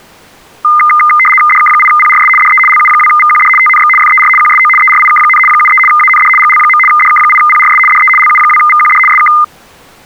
RTTY (75 baud, 850 Hz shift), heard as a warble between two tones, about 1650 Hz centre. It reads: DK8PRS DE LU2VQD TNX FER QSO ERIK, 73 AND GL. DK8PRS DE LU2VQD SK